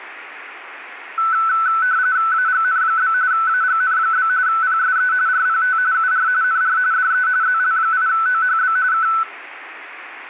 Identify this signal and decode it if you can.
RTTY (45.45 baud, 170 Hz shift), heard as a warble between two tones, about 1410 Hz centre. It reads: AGN? AGN? PSE RPT UR NR DE ZL8OHB K